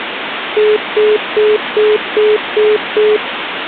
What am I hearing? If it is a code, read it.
Telephone call progress tone (single-tone plan, as in most of Europe), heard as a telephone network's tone, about 420 Hz, 0.2 s on and 0.2 s off, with phone line noise. Congestion tone.